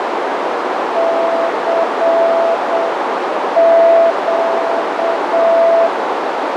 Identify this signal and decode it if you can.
Morse code, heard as a keyed tone, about 7 wpm, 670 Hz, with heavy radio static, fading and a narrow filter. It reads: CQ